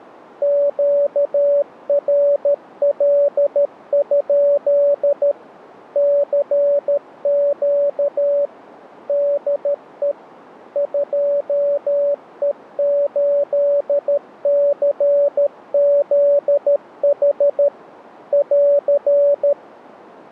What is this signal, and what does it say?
Morse code, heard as a keyed tone, machine-sent, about 13 wpm, 570 Hz. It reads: QRL? CQ DE 2E8CZH <AR>